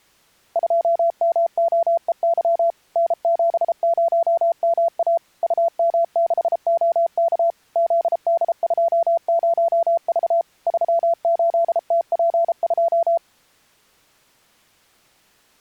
Morse code, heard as a keyed tone, machine-sent, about 33 wpm, 680 Hz. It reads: 2MOEY N70MA UM6OK ZD20V 38TP2